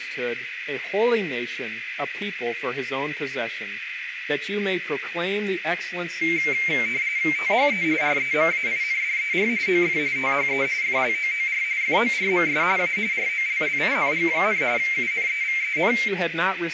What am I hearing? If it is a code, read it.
RTTY (45.45 baud, 170 Hz shift), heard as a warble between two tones, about 2200 Hz centre, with radio static and a narrow filter. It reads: THE REMAINDER OF THE FLOOR FORMS A ROLLING, UNEVEN